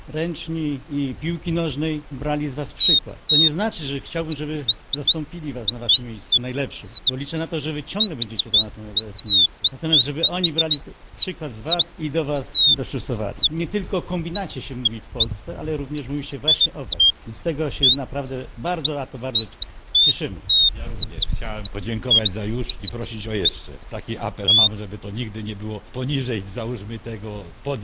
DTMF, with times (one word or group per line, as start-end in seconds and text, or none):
none